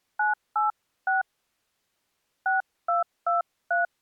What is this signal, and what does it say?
DTMF, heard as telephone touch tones, dialled by hand, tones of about 150 ms. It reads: 986 6223